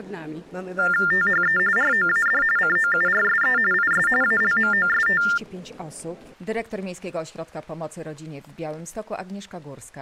TTY/TDD text telephone tones (45.45 baud Baudot), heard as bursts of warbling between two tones, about 400 Hz shift, 1600 Hz centre. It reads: THE ROAD COURSE IS ALMOST